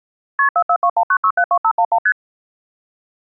Multi-frequency trunk signalling (R1, as on North American trunks), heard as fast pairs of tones, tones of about 70 ms. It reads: KP 44219672511 ST